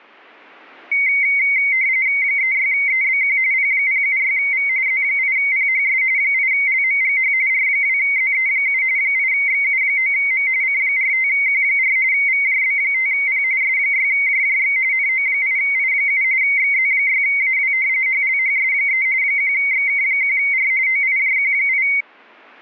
RTTY (45.45 baud, 170 Hz shift), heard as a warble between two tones, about 2150 Hz centre. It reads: 36EBQ P076V Z8PHS 8LMGH R2ZE7 8XU9M C45Q4 VJB5P S6JJX NO8I7 XZ6AW HLHS3 1XK1R OIJQ8